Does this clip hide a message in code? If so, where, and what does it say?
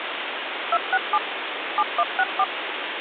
Yes: DTMF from 0.7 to 2.4 s, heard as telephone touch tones, dialled by machine, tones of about 50 ms, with phone line noise. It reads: 267 7164